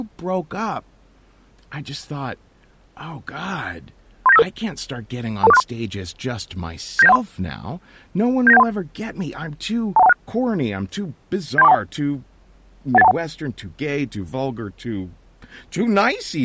Five-tone selective call (EIA), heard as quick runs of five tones, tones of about 30 ms, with speech in English. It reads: 37955 22463 79713 79713 21216 73421 18121